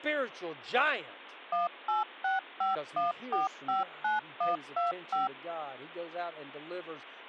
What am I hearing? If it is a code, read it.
DTMF, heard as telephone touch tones, dialled by machine, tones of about 150 ms, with speech in English. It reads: 18651459125